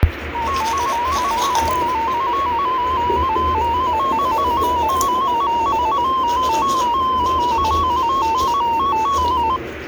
Multi-tone FSK (Olivia or MFSK type), about 250 Hz wide, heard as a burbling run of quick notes, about 15.625 baud, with radio static and the noise of a restroom.